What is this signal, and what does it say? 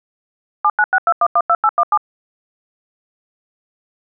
DTMF, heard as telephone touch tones, dialled by machine, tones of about 50 ms. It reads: 7962112817